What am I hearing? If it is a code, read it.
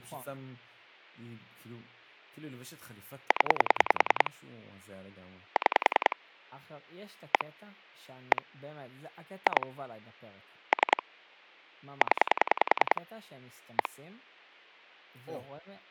Pulse dialling, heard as clicks on a phone line, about 10 pulses a second, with speech in Hebrew. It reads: 0 6 1 1 2 3 0 1